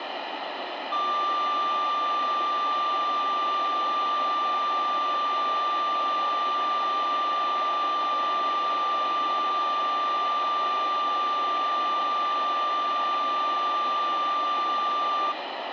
A steady tone, with phone line noise and room echo. There is no code.